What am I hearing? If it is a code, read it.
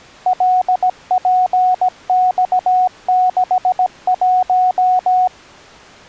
Morse code, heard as a keyed tone, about 17 wpm, 740 Hz. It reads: LPX61